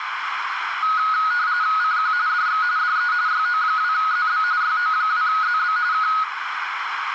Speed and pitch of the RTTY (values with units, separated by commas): 45.45 baud, 170 Hz shift, 1360 Hz centre